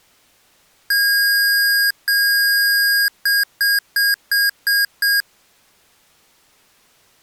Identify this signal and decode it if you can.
Beep code, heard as beeps from a small speaker, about 1650 Hz. 2 long, 6 short.